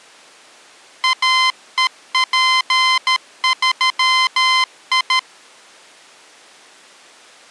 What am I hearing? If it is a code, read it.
Morse code, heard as electronic beeps, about 13 wpm, 1030 Hz. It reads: AEP3I